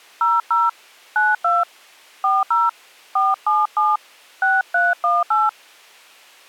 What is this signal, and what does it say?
DTMF, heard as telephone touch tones, dialled by hand, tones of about 190 ms. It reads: 00 92 40 477 6318